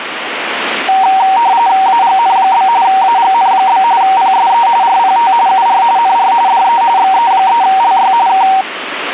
RTTY (45.45 baud, 170 Hz shift), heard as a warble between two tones, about 850 Hz centre, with radio static. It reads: AGN? AGN? PSE RPT UR NR DE XE3LY K